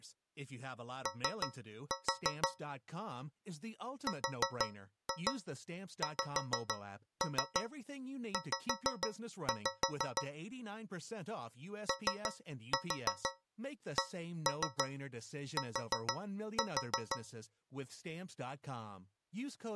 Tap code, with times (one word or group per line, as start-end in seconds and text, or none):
1.1-2.5 O
4.1-10.2 RXZ
11.9-17.2 OCT